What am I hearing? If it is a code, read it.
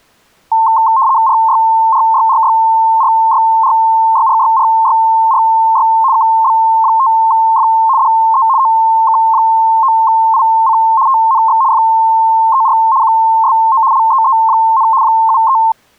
RTTY (75 baud, 170 Hz shift), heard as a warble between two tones, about 980 Hz centre. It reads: RYRYRYRYRYRYRYRY KB5F DE OK9IC TNX FER QSO LEE, 73